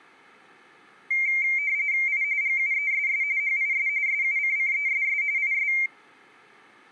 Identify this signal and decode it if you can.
RTTY (45.45 baud, 170 Hz shift), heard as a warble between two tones, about 2200 Hz centre. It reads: I GUESS HIS SUCCESS IS